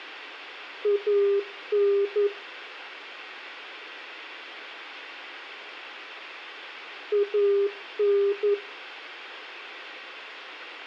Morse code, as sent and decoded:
.- -. / .- -.
AN AN

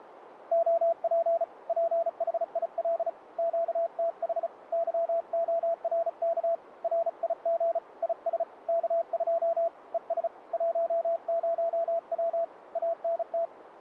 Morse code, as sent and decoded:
--- .--. / .--. .... .. .-.. / --.- - .... / -.-- --- .-. -.- / .-. .. --. / .. ... / -.- ..--- / . ... / .---- ----- .-- / .- -. -
OP PHIL QTH YORK RIG IS K2 ES 10W ANT

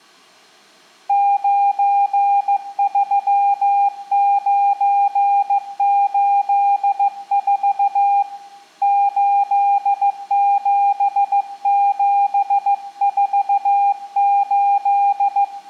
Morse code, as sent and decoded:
----. ...-- ----. ---.. ....- / ---.. --... --... ....- ---..
93984 87748

